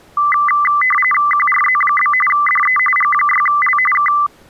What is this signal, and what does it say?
RTTY (45.45 baud, 850 Hz shift), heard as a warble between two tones, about 1600 Hz centre. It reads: QRZ? DE G6L K